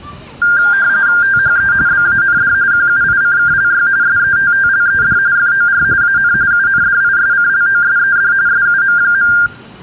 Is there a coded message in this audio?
Yes: RTTY (45.45 baud, 170 Hz shift) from 0.4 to 9.5 s, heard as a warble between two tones, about 1500 Hz centre, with the noise of a residential street. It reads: THE BAND QUICKLY SETTLED FOR AN UNDISCLOSED SUM.